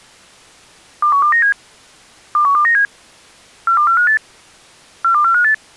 Five-tone selective call (CCIR), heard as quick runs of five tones, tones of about 100 ms. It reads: 21297 21297 42458 42458